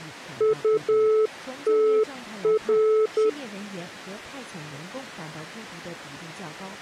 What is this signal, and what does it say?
Morse code, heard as a keyed tone, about 10 wpm, 430 Hz, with speech in Chinese. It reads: UTR